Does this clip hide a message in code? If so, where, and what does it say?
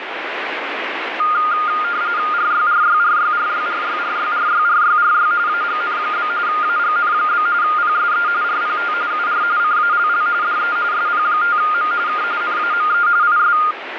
Yes: RTTY (45.45 baud, 170 Hz shift) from 1.2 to 13.7 s, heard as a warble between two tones, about 1320 Hz centre, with radio static. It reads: RYRYRYRYRYRYRYRYRY AGN? AGN? PSE RPT UR CALL DE SP5M K NAME IS